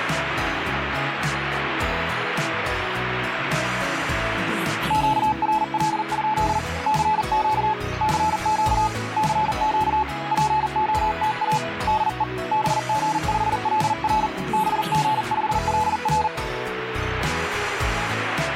Morse code, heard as a keyed tone, hand-sent with a paddle, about 40 wpm, 860 Hz, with radio static. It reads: QRL? CQ CQ CQ POTA DE BG5LR BG5LR